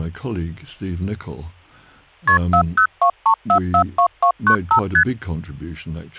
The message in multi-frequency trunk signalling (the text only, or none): KP 4023442295 ST